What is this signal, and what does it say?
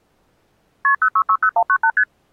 Multi-frequency trunk signalling (R1, as on North American trunks), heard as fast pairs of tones, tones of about 70 ms. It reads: KP 0660198 ST